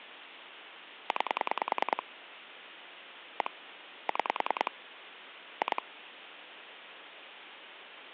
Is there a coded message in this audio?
Yes: pulse dialling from 1.1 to 5.8 s, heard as clicks on a phone line, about 10 pulses a second, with phone line noise. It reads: 9 1 6 2